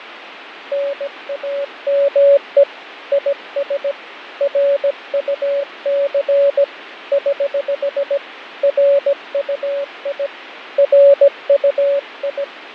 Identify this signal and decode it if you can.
Morse code, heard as a keyed tone, hand-sent with a paddle, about 17 wpm, 560 Hz, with radio static and fading. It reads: NAME IS RUC <HH> RUI RUI